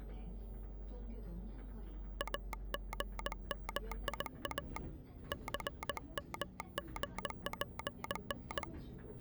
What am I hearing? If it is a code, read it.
Morse code, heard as a telegraph sounder, hand-sent with a straight key, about 19 wpm, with the noise inside a bus. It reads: AGMIA CMGPN